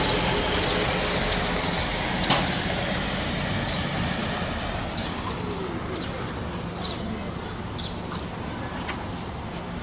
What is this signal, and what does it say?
The noise of a residential street. There is no code.